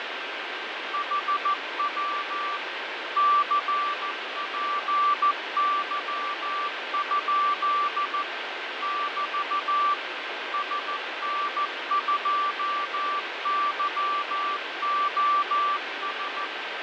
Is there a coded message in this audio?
Yes: Morse code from 0.9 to 16.5 s, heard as a keyed tone, machine-sent, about 14 wpm, 1170 Hz, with radio static and fading. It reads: HW CPY? <BT> SN2YOS